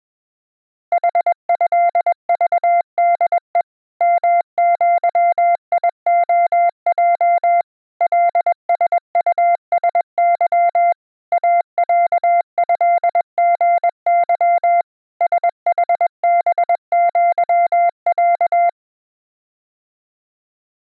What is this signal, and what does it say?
Morse code (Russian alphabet), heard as a keyed tone, machine-sent, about 21 wpm, 690 Hz. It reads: ХЭЖДЕ МЪИОЙ ЛСУСЫ АЯЭГЫ СХБЪЯ